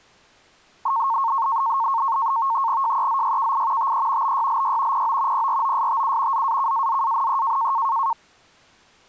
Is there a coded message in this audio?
Yes: NAVTEX (SITOR-B), 100 baud, 170 Hz shift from 0.9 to 8.1 s, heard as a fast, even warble, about 1000 Hz centre. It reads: JEZYKI TE BYLY PO PROSTU ZAKAZANE